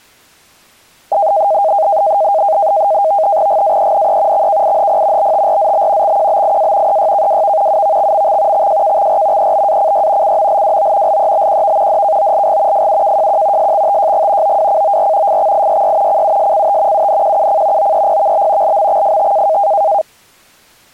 NAVTEX (SITOR-B), 100 baud, 170 Hz shift, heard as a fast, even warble, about 720 Hz centre. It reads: GAENE XKIHP BTRZB XQBIA EYKWV UVXMX XJKXR EBACY CMLWO LEBQV DKOLG FUKJQ SXTJG OWCOR FXIYY CUSCT UNQUC OEPVB LMXFT